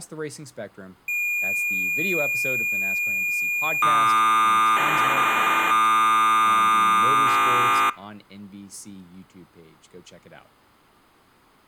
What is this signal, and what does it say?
Cassette data (Kansas City type), 1200 baud, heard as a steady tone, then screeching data, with speech in English.